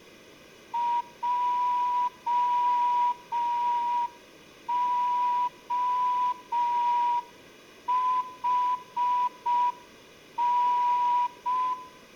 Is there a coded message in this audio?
Yes: Morse code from 0.7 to 11.8 s, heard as a whistle, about 5 wpm, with room echo. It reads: JOHN